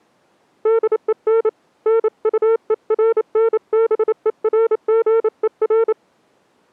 Morse code, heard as a keyed tone, hand-sent with a paddle, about 28 wpm, 460 Hz. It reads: DEN NUERNBERGER